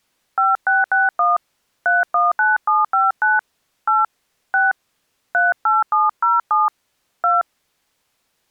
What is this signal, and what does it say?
DTMF, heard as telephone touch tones, dialled by hand, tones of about 180 ms. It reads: 5661 319759 8 6 38707 2